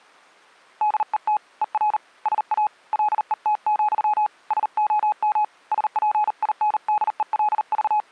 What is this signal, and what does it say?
Morse code, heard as a keyed tone, hand-sent with a paddle, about 39 wpm, 840 Hz. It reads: DET ER SA LET, SOM …